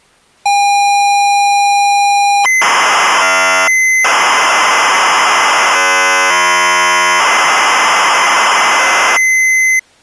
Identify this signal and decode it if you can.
ZX Spectrum tape loading, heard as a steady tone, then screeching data.